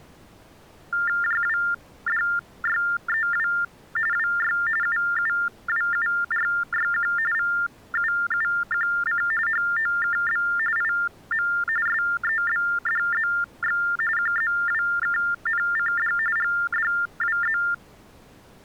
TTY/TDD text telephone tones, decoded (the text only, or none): JWDYEW WY UUWURYQ VUUQC HOKB IM SEBDZX QZWKNCD GDWZ